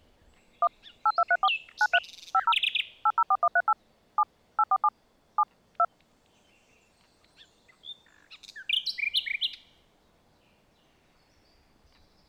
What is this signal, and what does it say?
DTMF, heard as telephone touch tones, dialled by machine, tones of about 50 ms. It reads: 1 8234 93 50 804138 7 847 7 2